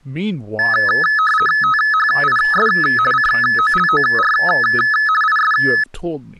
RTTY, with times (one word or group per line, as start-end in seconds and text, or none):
1.6-2.7 THIS
3.1-4.3 COLOR
5.2-5.5 IS